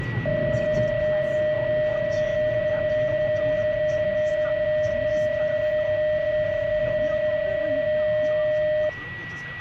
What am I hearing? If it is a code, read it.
PSK31 (31.25 baud), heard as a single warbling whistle, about 610 Hz, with a steady whistle near 1940 Hz and the noise inside a car.